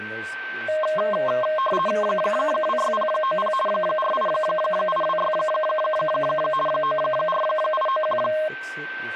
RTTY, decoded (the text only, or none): 26090 48826 94891